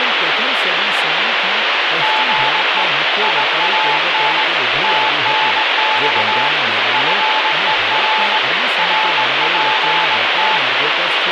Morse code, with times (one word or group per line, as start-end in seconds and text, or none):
2.0-2.8 GE
3.2-4.4 IAN
4.8-6.5 TNX
6.9-8.4 FER
8.8-10.6 RPT